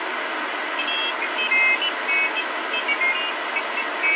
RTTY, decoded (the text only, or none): none